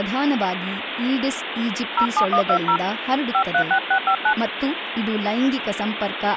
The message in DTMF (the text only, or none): 07120 536659